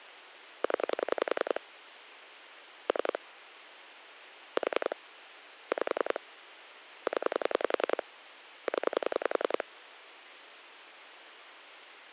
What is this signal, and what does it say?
Pulse dialling, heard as clicks on a phone line, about 10 pulses a second, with phone line noise. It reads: 0 3 4 5 0 0